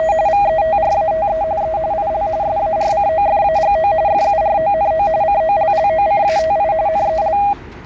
RTTY (45.45 baud, 170 Hz shift), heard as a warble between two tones, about 720 Hz centre, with the noise of a residential street. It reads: … VETRATE E IL SARCOFAGO FURONO COLLOCATI NEL